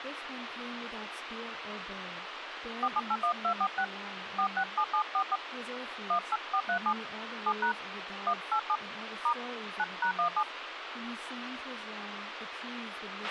DTMF, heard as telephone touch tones, dialled by hand, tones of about 70 ms, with radio hiss, a squelch burst at the end and speech in English. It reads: 4781246 467744 18437 7# 187 * 9#17